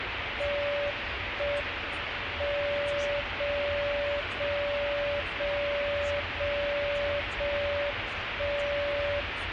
Radio time signal (JJY), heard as a tone whose level steps once a second, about 580 Hz, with radio static and the noise inside a car. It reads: 1 M 0 0 0 0 0 1 0